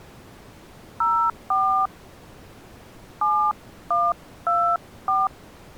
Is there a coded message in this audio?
Yes: DTMF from 1.0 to 5.3 s, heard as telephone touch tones, dialled by hand, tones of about 250 ms. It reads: 04 7124